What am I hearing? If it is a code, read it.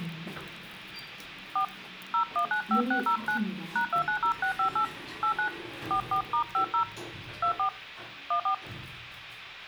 DTMF, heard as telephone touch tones, dialled by hand, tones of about 100 ms, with the noise inside a lift. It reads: 4 0195609 #290658 89 44*50 24 14